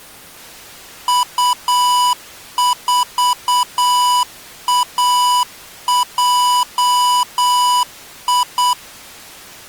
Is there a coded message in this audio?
Yes: Morse code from 1.0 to 8.8 s, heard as electronic beeps, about 8 wpm, 990 Hz. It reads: U4AJI